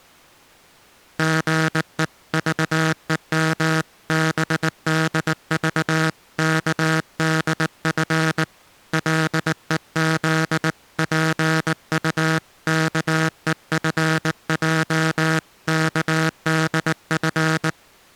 Morse code (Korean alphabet), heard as a buzzer, hand-sent with a paddle, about 19 wpm. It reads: 사람들은 같지않은